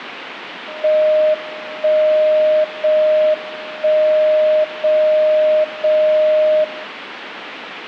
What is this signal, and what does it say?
Radio time signal (JJY), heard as a tone whose level steps once a second, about 620 Hz. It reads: 1 0 1 0 0 0